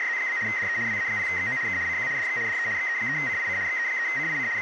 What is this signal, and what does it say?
RTTY (75 baud, 170 Hz shift), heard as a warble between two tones, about 1950 Hz centre, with radio static and speech in Finnish. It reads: … DE WA0XO K CQ DX DE XE3CIC XE3CIC …